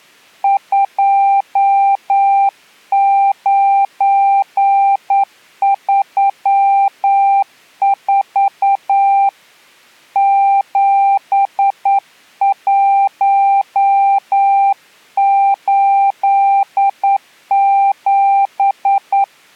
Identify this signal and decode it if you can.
Morse code, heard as a keyed tone, hand-sent with a straight key, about 9 wpm, 790 Hz. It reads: 2934 7187